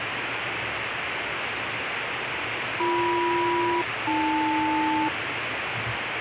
Aircraft SELCAL, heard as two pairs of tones, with radio static and the noise inside a car. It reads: BM-AL